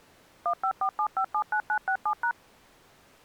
DTMF, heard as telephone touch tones, dialled by machine, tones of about 80 ms. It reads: 1547579967#